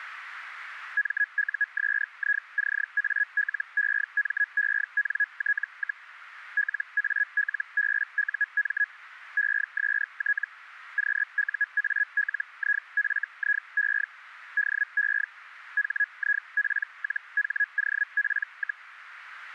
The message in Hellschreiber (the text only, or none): MUSICALEMENT, LALBUM EST QUALIFIE DE HIP-HOP,